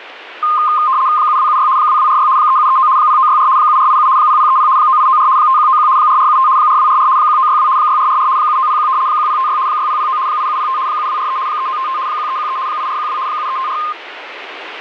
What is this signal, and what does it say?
RTTY (75 baud, 170 Hz shift), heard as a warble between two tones, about 1140 Hz centre, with radio static. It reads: 7276 2246 3739 0964 7487 0030 9894 5191 4475 4244 1962 6444 7901 1056 6009 8705 7243 3955 1313 8412 7354